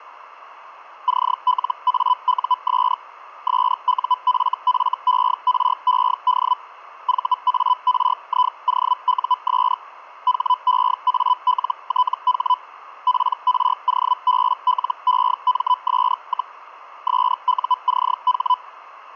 Hellschreiber (Feld-Hell, 122.5 baud), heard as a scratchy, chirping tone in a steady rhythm, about 1000 Hz, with radio static. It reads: CLAUS SUFFERED VARIOUS HEALTH PROBLEMS, SUCH